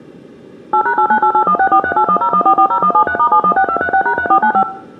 DTMF, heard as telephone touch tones, dialled by machine, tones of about 80 ms, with room echo. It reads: 8#898816438101440173*716236#3495